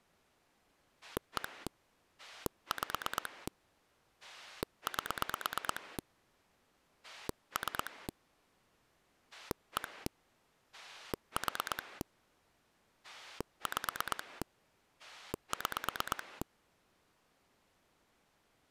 Pulse dialling, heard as a rotary dial, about 8 pulses a second. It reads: 1 5 8 3 1 4 5 6